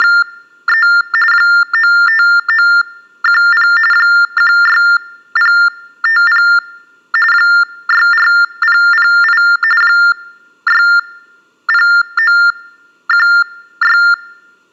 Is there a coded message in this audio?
Yes: TTY/TDD text telephone tones (45.45 baud Baudot) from 0.0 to 14.1 s, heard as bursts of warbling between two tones, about 400 Hz shift, 1600 Hz centre. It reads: … 95910 16050 64008 60916